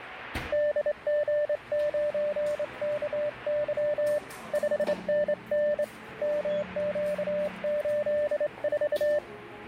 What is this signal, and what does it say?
Morse code, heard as a keyed tone, hand-sent with a straight key, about 25 wpm, 590 Hz, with radio static and the noise of a crowd indoors. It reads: DG9KY 5NN MQ84